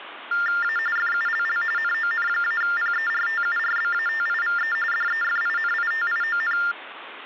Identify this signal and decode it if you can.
TTY/TDD text telephone tones (45.45 baud Baudot), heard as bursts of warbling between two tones, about 400 Hz shift, 1600 Hz centre, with phone line noise. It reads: A FULL NON-PERTURBATIVE DEFINITION